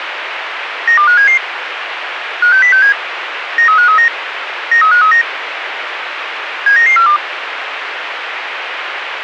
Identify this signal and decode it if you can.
Five-tone selective call (CCIR), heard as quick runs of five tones, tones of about 100 ms, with radio hiss. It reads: 92577 56067 93539 93539 79942